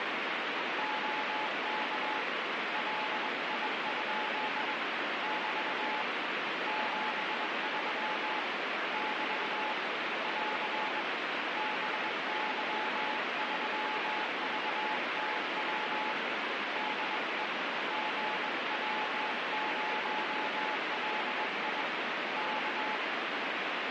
Morse code, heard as a keyed tone, hand-sent with a bug key, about 21 wpm, 860 Hz, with heavy radio static. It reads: OK LI? <BT> 73 <BT> <AR> BY3VTW DE GW0LI K